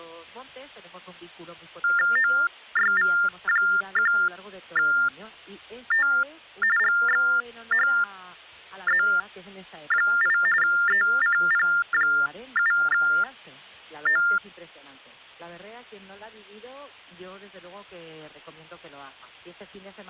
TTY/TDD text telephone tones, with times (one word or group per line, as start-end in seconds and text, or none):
2.2-6.1 OYV1T
6.8-10.4 GXHZ8
10.6-14.2 ECP7O